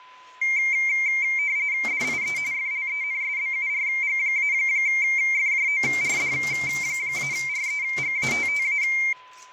RTTY (45.45 baud, 170 Hz shift), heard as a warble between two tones, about 2200 Hz centre, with a steady whistle near 1010 Hz and kitchen noise. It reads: DIE FLENSBURG-FJORD-REGATTA